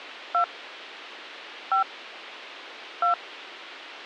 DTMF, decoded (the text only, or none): 2 5 2